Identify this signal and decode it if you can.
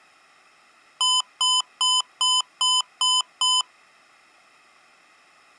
Beep code, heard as beeps from a small speaker, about 1010 Hz. 7 short. In AMI BIOS tables: virtual mode exception error; in Dell tables: processor failure.